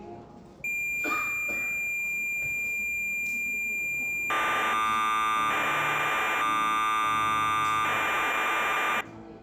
Cassette data (Kansas City type), 1200 baud, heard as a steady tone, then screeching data, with the noise of a crowd indoors.